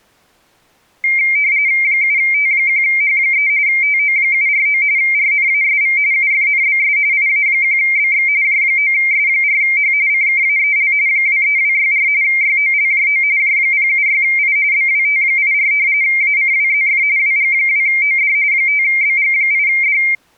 RTTY (45.45 baud, 170 Hz shift), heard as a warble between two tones, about 2200 Hz centre. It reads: 7T1H3 TO749 RNASV UFNBS IA1BX J9S4H CKAEL 23264 YOLJO J076I BWT84 ACWZF WG2OD 5BG8D